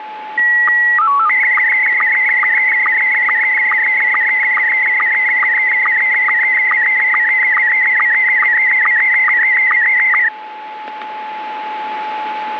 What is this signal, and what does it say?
SSTV (slow-scan television), Scottie S1, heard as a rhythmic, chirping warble, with radio static and a steady whistle near 860 Hz.